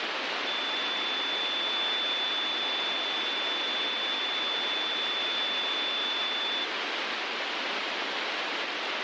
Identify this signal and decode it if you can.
A steady tone, with heavy radio static. There is no code.